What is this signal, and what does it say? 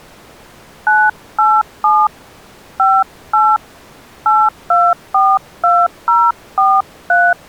DTMF, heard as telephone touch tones, dialled by hand, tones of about 230 ms. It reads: 987 58 8242043